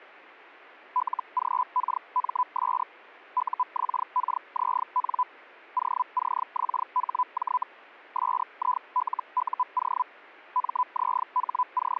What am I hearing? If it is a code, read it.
Hellschreiber (Feld-Hell, 122.5 baud), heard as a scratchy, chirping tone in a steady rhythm, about 1000 Hz. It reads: LGKMS UXKZN OCXHJ SILUO …